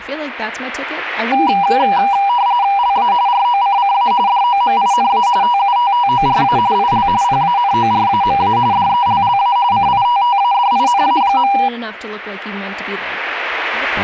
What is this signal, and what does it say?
RTTY (45.45 baud, 170 Hz shift), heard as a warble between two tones, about 880 Hz centre, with speech in English. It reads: LA ROCCA DOMINA TUTTORA IL PANORAMA DELLA CITTADINA.